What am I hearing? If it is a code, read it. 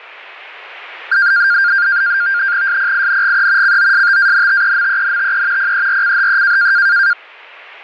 NAVTEX (SITOR-B), 100 baud, 170 Hz shift, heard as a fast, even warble, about 1500 Hz centre. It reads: SPINGE COSTANTEMENTE PERCHE